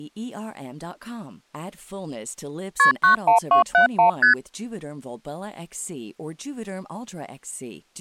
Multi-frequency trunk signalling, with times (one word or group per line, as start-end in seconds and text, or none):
2.8-2.9 KP
3.0-4.1 91271
4.2-4.3 ST